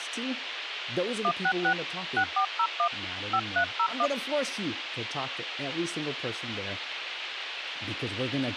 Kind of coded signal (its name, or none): DTMF